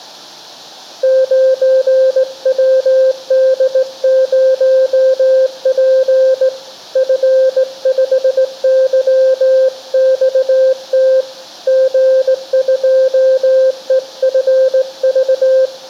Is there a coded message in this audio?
Yes: Morse code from 1.0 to 15.7 s, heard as a keyed tone, hand-sent with a straight key, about 18 wpm, 520 Hz, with room echo. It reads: 9WD0P F5YXT G2EFV